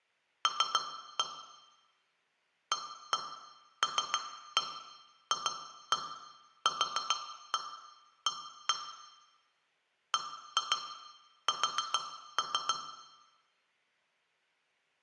Tap code, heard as taps on glass, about 7 knocks a second, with room echo. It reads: L ALFQA BS